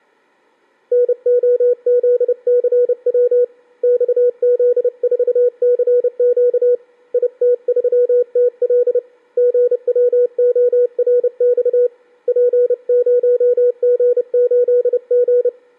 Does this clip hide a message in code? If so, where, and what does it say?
Yes: Morse code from 0.9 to 15.5 s, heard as a keyed tone, hand-sent with a paddle, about 30 wpm, 490 Hz. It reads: NOZCW XZ4CQ IT3TL GWORX P0G8G